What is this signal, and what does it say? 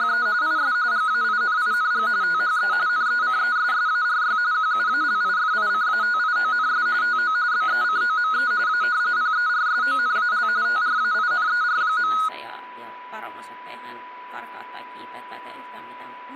RTTY (45.45 baud, 170 Hz shift), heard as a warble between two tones, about 1360 Hz centre, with a steady whistle near 990 Hz and speech in Finnish. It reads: … IS GAINING THE NECESSARY QUALIFICATIONS TO BECOME A PERSONAL TRAINER.